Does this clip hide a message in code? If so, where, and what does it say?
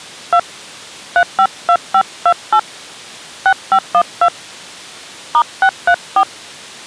Yes: DTMF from 0.3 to 6.2 s, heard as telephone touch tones, dialled by hand, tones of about 70 ms. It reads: 2 352528 6512 *634